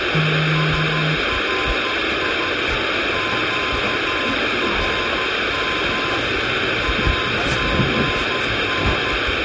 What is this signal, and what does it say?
Morse code, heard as a keyed tone, machine-sent, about 13 wpm, 1040 Hz, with heavy radio static and the noise of a subway station. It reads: SRI QRM AGN